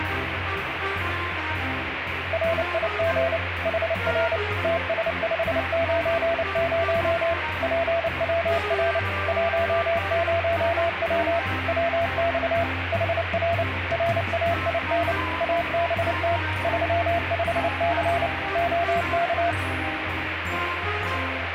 Morse code, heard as a keyed tone, machine-sent, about 29 wpm, 680 Hz, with radio static. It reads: RIG HR TS590 PWR 10W WX HR RAIN ABT 35C OK